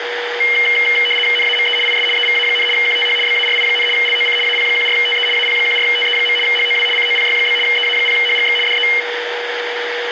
RTTY (75 baud, 850 Hz shift), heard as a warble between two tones, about 2550 Hz centre, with radio static and a steady whistle near 480 Hz. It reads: NAME IS EVA, QTH BARI, LOC AP14TE AP14TE. HOW COPY? EA0HGX DE